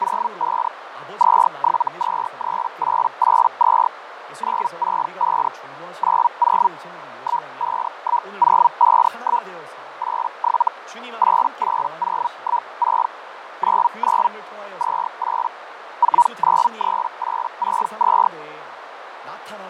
Hellschreiber (Feld-Hell, 122.5 baud), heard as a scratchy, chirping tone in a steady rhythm, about 960 Hz, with radio static, fading, a narrow filter and speech in Korean. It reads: 05 2723882 965 90 151051 87 88016 99 28 493862